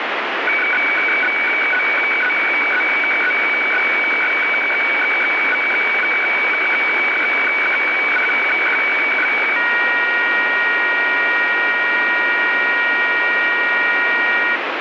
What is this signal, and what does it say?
Weather fax (radiofax), 120 lines a minute, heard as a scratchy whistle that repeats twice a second, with radio static.